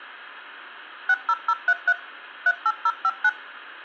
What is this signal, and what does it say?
DTMF, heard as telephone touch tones, dialled by machine, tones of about 50 ms, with room echo. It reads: 60033 38059